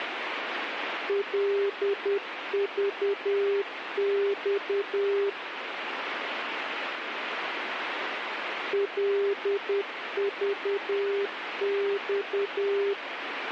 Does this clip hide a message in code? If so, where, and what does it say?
Yes: Morse code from 1.0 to 13.0 s, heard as a keyed tone, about 10 wpm, 400 Hz, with radio static. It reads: LVX LVX